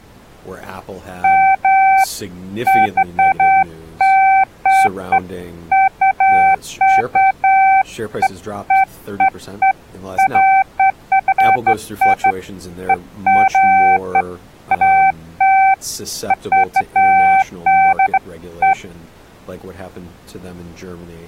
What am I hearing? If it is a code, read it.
Beeps of irregular length, with speech in English. There is no code.